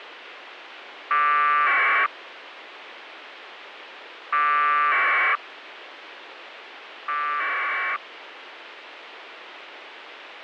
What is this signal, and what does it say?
Packet radio (AX.25, as in APRS), 1200 baud, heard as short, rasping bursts, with radio hiss.